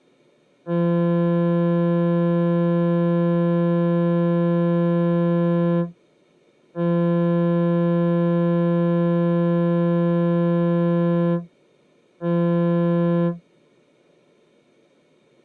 Ship horn signal, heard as a ship's horn, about 170 Hz. 2 long, 1 short. At sea: I intend to overtake on your starboard side.